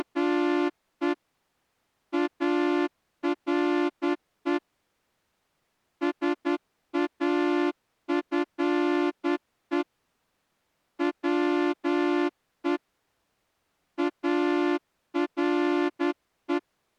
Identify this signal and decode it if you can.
Morse code, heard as a horn, hand-sent with a straight key, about 10 wpm. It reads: … ARE SAFE WE ARE